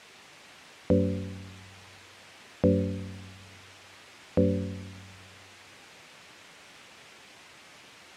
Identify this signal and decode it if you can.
Clock strike, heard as a bell. 3. Three o'clock.